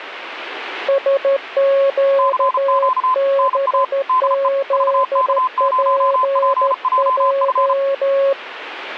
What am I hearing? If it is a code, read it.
Morse code, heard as two keyed tones. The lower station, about 13 wpm, 550 Hz: SQBZPJ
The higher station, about 34 wpm, 1030 Hz: CQ NA DE VK0PJF